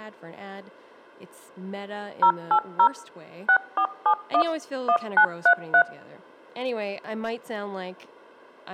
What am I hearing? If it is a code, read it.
DTMF, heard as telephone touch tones, dialled by machine, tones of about 80 ms, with speech in English. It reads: 080 6471 1933